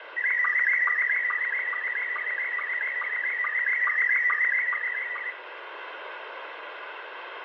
SSTV (slow-scan television), Scottie S1, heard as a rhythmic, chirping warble, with radio static and room echo.